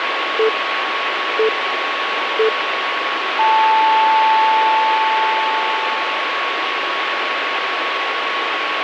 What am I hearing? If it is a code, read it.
Radio time signal (three low pips and a long one an octave up, as on NHK), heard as pips, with radio static and a steady whistle near 1110 Hz.